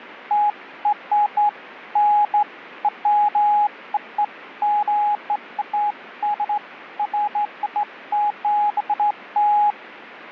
Beeps of irregular length. There is no code.